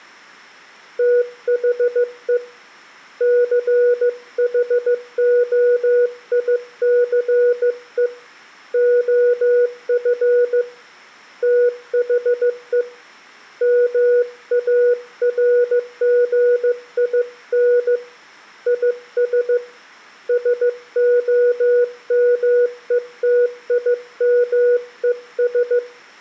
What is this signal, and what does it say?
Morse code, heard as a keyed tone, hand-sent with a bug key, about 15 wpm, 490 Hz, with room echo. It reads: THE CHOICE OF THE MARGIN IS SOMETIMES